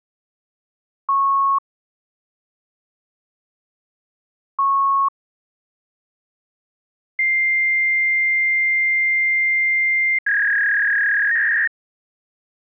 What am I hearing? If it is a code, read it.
Fax machine handshake, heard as beeps, a long tone and a warble.